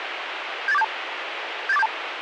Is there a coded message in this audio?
Yes: five-tone selective call (EIA) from 0.7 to 1.9 s, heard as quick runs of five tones, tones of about 30 ms, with radio hiss. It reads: 78472 78472